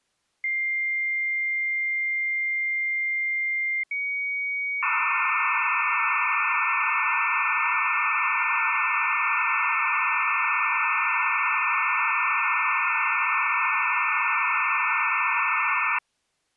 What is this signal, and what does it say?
Dial-up modem handshake (low-speed, two carriers), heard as two whistles, then hiss.